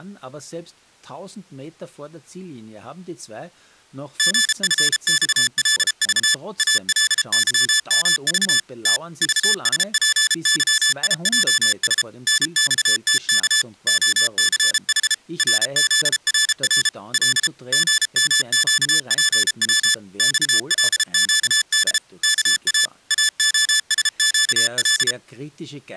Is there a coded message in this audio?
Yes: Morse code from 4.1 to 25.2 s, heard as electronic beeps, machine-sent, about 33 wpm, 1750 Hz, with speech in German. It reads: GFXLV ALYMV T VSPYIJS NXTK OCH RZRR L GMQPW XLQD KA AOSQL